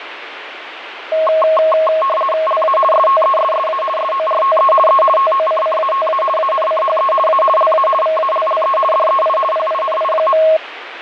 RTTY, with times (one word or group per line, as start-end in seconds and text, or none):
2.5-2.8 LA
2.9-3.8 STESSA
4.0-4.7 SORTE
4.9-5.0 E
5.2-6.2 TOCCATA
6.4-7.1 ANCHE
7.3-7.4 A
7.6-7.9 LA
8.0-8.8 VALLE
8.9-9.4 DEI
9.5-10.4 PINI.